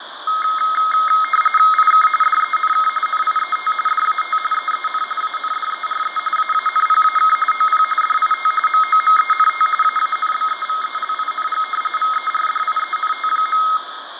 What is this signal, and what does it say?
RTTY (45.45 baud, 850 Hz shift), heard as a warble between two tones, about 1700 Hz centre, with radio static, fading and room echo. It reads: IK DENK NIET DAT EEN ANDERE AANPAK OP DIT MOMENT AANBEVELING VERDIENT.